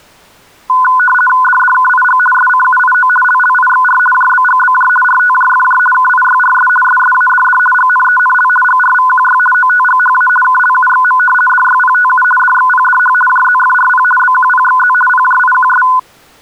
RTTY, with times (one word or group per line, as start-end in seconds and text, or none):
1.4-2.2 DDKIG
2.3-3.1 SCUIO
3.2-4.0 LLIXR
4.1-4.9 JBGBJ
5.0-5.8 RTJFJ
5.9-6.7 KIYRS
6.8-7.6 SSADD
7.7-8.5 GNENL
8.6-9.4 GRVQY
9.5-10.3 OTGHA
10.4-11.2 KLUXM
11.5-12.2 DYPTU
12.4-13.1 DXPDH
13.3-14.0 JZFRP
14.2-14.9 BQPXZ
15.1-15.8 PJIQS